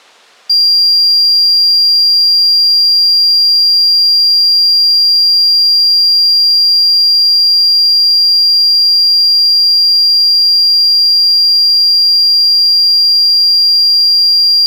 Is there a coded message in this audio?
No, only a steady tone.